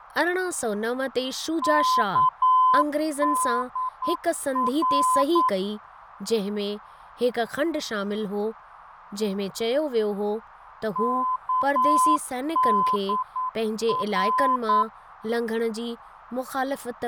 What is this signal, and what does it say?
Morse code, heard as a keyed tone, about 9 wpm, 1020 Hz, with radio static, fading, a narrow filter and speech in Sindhi. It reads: KDR KDR